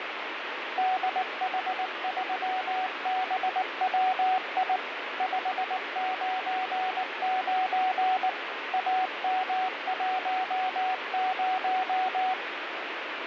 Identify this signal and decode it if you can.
Morse code, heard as a keyed tone, machine-sent, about 19 wpm, 750 Hz, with radio static. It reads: DH3BWI 599 AM10